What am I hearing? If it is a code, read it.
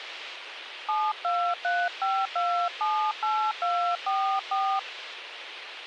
DTMF, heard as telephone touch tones, dialled by hand, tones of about 290 ms, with radio hiss. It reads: 7235278244